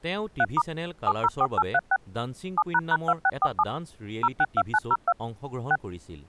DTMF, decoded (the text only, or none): 3* 704836 7##2647 062902 6